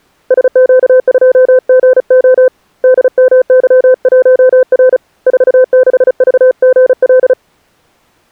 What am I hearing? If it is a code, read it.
Morse code, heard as a keyed tone, hand-sent with a paddle, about 35 wpm, 510 Hz. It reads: SQ2GO DMY1R 46VGL